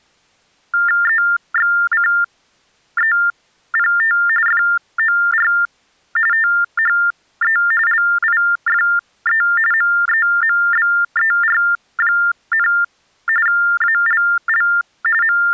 TTY/TDD text telephone tones (45.45 baud Baudot), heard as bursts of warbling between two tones, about 400 Hz shift, 1600 Hz centre. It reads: EXCEPT FOR THE LIFE MEMBER, ALL …